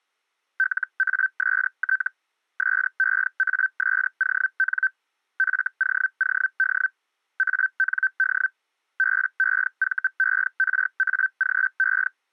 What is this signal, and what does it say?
Hellschreiber (Feld-Hell, 122.5 baud), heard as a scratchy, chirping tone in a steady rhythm, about 1550 Hz. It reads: LAST SEASON FOOD AND BEVERAGE